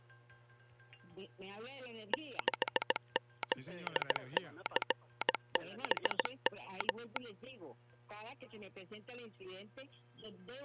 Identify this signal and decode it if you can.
Morse code, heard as a telegraph sounder, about 17 wpm. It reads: 6ZCBM